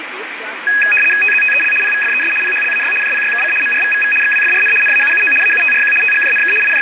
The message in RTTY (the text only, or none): TZTEL PVFES PHLAY JPYKC MRVVV XWFRN NAUUO AUTRQ TGJNK …